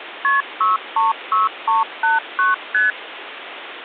Multi-frequency trunk signalling (R1, as on North American trunks), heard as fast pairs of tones, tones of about 160 ms, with phone line noise. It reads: KP 636389 ST